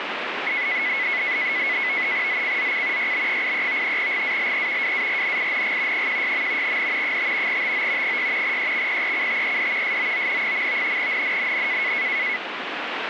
NAVTEX (SITOR-B), 100 baud, 170 Hz shift, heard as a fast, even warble, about 2100 Hz centre, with radio static. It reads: ZCZC YB83 GALE WARNING 16. N 5 TO 6 EXPECTED SOON. NNNN